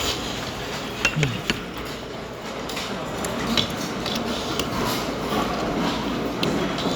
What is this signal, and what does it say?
The noise of a restaurant. There is no code.